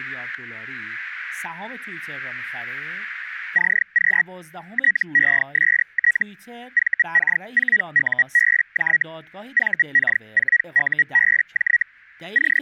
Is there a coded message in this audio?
Yes: Hellschreiber (Feld-Hell, 122.5 baud) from 3.5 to 12.6 s, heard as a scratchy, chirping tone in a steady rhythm, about 1900 Hz, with static crashes and speech in Persian. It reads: CQ TEST VK4UBJ VK4UBJ …